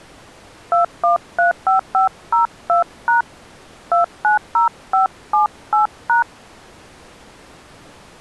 DTMF, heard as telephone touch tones, dialled by hand, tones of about 130 ms. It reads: 2135502# 290578#